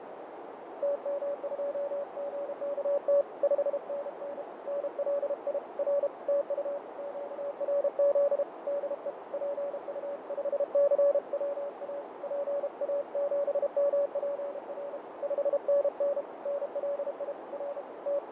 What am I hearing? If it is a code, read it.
Morse code, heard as a keyed tone, hand-sent with a paddle, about 32 wpm, 570 Hz, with heavy radio static, fading and a narrow filter. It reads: TM2GKT 5NN NLI R TU QRZ DE PU5CWA PA7MPR 5NN NLI R …